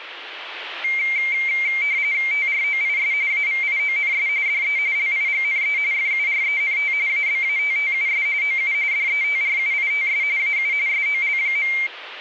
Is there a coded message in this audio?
Yes: RTTY (45.45 baud, 170 Hz shift) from 0.8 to 11.9 s, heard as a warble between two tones, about 2200 Hz centre, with radio static. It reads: TROIS AVIONS DE LIGNE FURENT ABATTUS OU DETRUITS AU SOL.